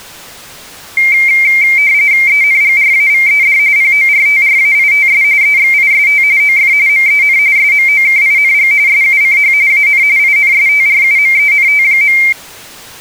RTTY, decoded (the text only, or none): ENGRAVED PORTRAITS EXIST OF MEN SMOKING SUCH AN INSTRUMENT.